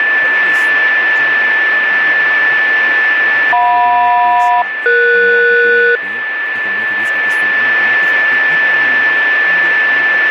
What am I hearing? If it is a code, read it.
Aircraft SELCAL, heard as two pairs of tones, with radio static, a steady whistle near 1750 Hz and speech in Italian. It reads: JM-ES